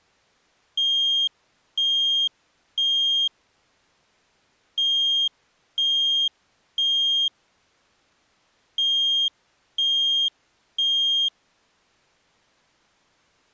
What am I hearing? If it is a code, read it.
Alarm pattern, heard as an alarm's beeps, played three times, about 3200 Hz. Temporal three. Smoke or fire, evacuate.